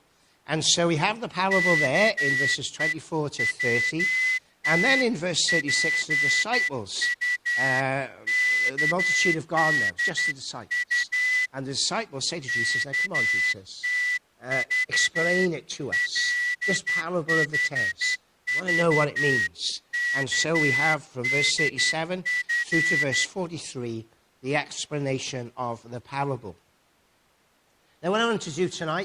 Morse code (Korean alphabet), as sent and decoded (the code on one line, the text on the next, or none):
-.- . .-- - .--. ..- -.- -.. ..- / -.- - ...- .-.. .... ...- -.- -.. ..-.
아버지의 얼굴은